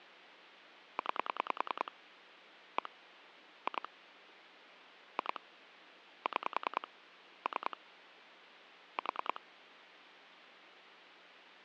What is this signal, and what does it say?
Pulse dialling, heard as clicks on a phone line, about 10 pulses a second. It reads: 9 1 2 2 6 3 4